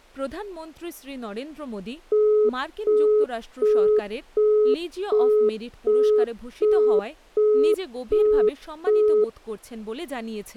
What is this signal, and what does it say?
Telephone call progress tone (as in the UK, Australia and similar networks), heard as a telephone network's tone, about 420 Hz, 0.375 s on and 0.375 s off, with speech in Bangla. Busy tone.